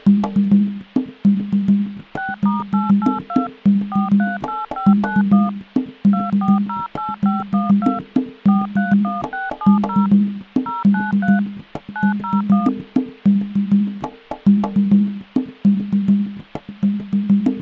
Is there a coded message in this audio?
Yes: DTMF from 2.2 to 12.7 s, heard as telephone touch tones, dialled by machine, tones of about 170 ms. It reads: 6*882 438591 2408512 431670 093 901